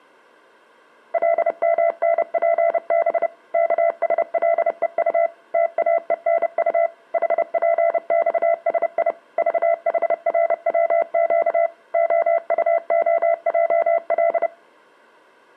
Morse code, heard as a keyed tone, machine-sent, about 30 wpm, 670 Hz. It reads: LMNPB KSLEU TAENU HPXSI VHRWQ OUOJL